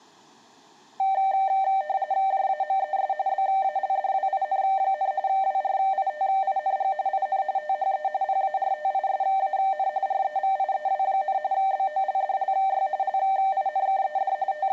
RTTY (45.45 baud, 170 Hz shift), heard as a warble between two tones, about 690 Hz centre. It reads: JAMES BALDWIN, WRITING IN THE PARTISAN REVIEW, BOLDLY LINKED …